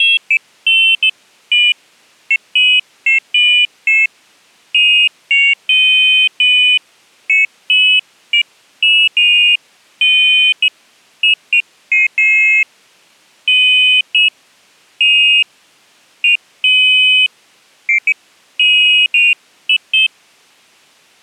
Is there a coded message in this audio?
No, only pairs of high tones at irregular times.